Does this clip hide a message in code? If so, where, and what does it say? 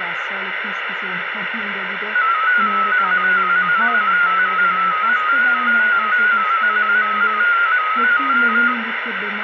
Yes: multi-tone FSK (Olivia or MFSK type), about 250 Hz wide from 2.1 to 8.7 s, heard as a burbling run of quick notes, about 15.625 baud, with radio static.